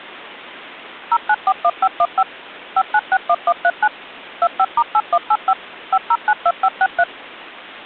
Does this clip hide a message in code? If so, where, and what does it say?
Yes: DTMF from 1.1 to 7.0 s, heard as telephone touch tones, dialled by machine, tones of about 60 ms. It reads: 0941515 5961139 25*8185 5092563